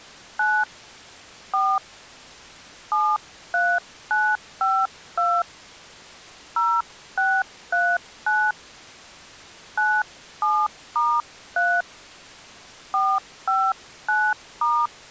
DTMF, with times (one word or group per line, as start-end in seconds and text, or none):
0.4-0.6 9
1.5-1.8 4
2.9-5.4 73952
6.6-8.5 0639
9.8-11.8 97*3
12.9-14.9 459*